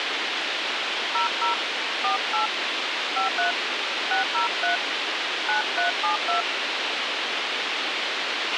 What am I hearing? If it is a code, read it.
DTMF, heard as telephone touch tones, dialled by hand, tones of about 120 ms, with radio hiss and a squelch burst at the end. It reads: 00 48 53 603 9372